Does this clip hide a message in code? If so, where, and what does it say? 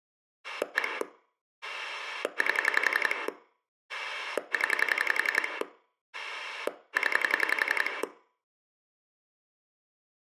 Yes: pulse dialling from 0.4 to 8.0 s, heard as a rotary dial, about 11 pulses a second, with room echo. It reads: 1 8 0 0